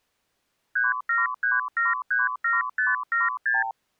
Multi-frequency trunk signalling (R2, with the far end's replies), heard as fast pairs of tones, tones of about 170 ms. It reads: 373737576